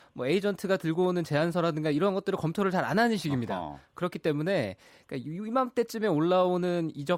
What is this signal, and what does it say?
Speech in Korean. There is no code.